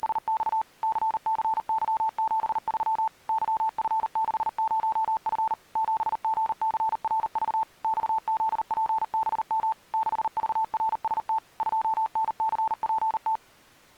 Morse code, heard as a keyed tone, machine-sent, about 39 wpm, 880 Hz. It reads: … CCY73 YF60F 7GCRV XZPBM 6VRST 2NCPT